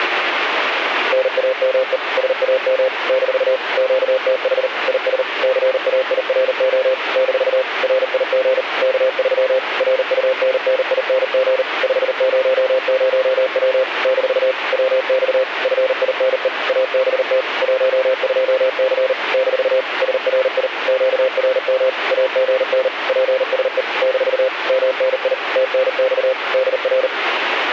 Morse code, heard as a keyed tone, machine-sent, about 39 wpm, 520 Hz, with radio static. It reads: NAME SAM - QTH IS CAIRO - RIG K3 RUNNING 500W - WX FINE ABT 12C - SRI QRM AGN PSE - MNI TNX DR